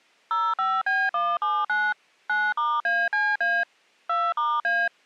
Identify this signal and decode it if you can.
DTMF, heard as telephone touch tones, dialled by machine, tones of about 230 ms. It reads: 05B179 9*ACA 2*A